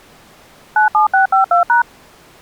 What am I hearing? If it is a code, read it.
DTMF, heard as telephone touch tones, dialled by machine, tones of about 120 ms. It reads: 97652#